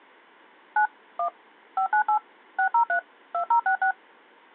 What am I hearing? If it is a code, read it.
DTMF, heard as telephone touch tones, dialled by machine, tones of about 100 ms. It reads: 9 1 598 603 2066